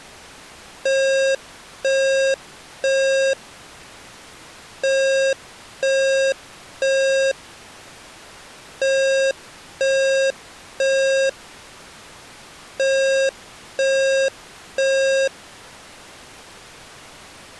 Alarm pattern, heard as an alarm's beeps, played four times, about 540 Hz. Temporal three. Smoke or fire, evacuate.